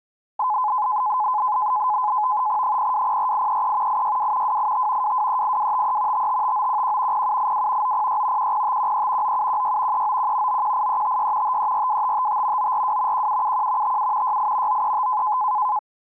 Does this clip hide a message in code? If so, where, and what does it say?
Yes: NAVTEX (SITOR-B), 100 baud, 170 Hz shift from 0.4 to 15.8 s, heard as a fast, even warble, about 930 Hz centre. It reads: 0204833 862 285 2238253 555911 0782 906 10513 9716 391 918356 5342555 942 1771 57 68 935